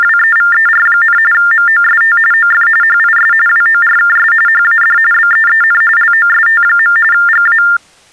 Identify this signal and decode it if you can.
TTY/TDD text telephone tones (45.45 baud Baudot), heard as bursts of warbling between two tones, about 400 Hz shift, 1600 Hz centre. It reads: … MOST OF HIS WORKS HAD BEEN LOST. GA